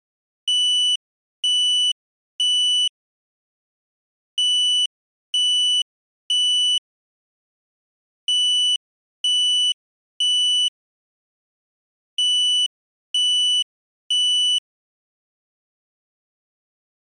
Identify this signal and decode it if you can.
Alarm pattern, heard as an alarm's beeps, played four times, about 2950 Hz. Temporal three. Smoke or fire, evacuate.